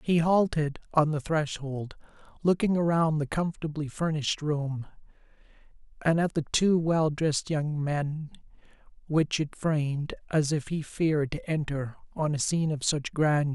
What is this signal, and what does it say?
Speech in English. There is no code.